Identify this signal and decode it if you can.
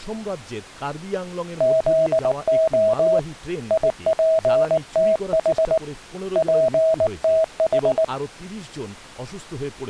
Morse code (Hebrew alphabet), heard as a keyed tone, hand-sent with a paddle, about 19 wpm, 640 Hz, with speech in Bangla. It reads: זה יפתח פתח